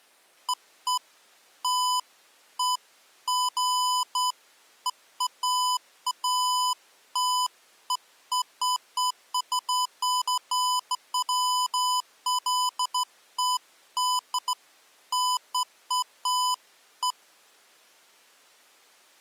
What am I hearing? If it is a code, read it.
Beeps of irregular length. There is no code.